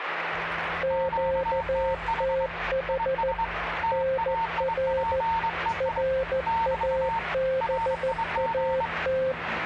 Morse code, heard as two keyed tones, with radio static and the noise inside a bus. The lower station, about 14 wpm, 530 Hz: QTH NR RABAT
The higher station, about 24 wpm, 910 Hz: QTH IS TAIPEI <BT> RIG